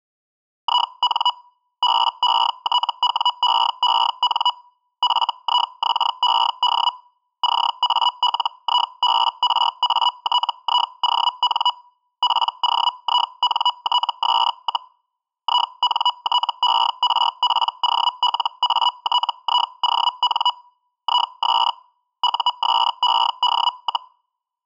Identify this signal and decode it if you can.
Hellschreiber (Feld-Hell, 122.5 baud), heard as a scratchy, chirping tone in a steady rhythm, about 980 Hz. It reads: IN BETWEEN FIXED CALIBRATION POINTS, INTERPOLATION IS USED,